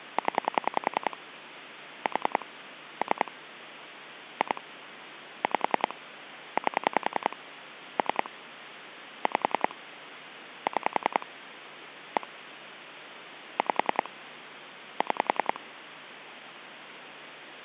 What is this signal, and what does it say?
Pulse dialling, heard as clicks on a phone line, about 10 pulses a second, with phone line noise. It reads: 0 4 3 2 5 8 3 5 6 1 5 6